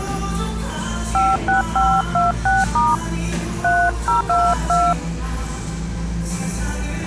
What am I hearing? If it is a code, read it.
DTMF, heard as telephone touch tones, dialled by hand, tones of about 200 ms, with the noise of a cafe. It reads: 56526* 3022